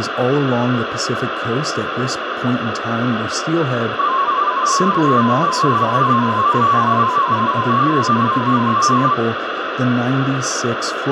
Multi-tone FSK (Olivia or MFSK type), about 250 Hz wide, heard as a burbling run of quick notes, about 31.25 baud, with radio static and speech in English.